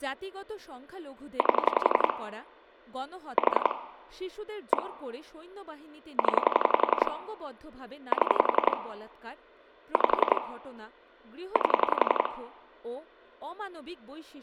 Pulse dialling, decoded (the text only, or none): 8 4 1 0 7 5 8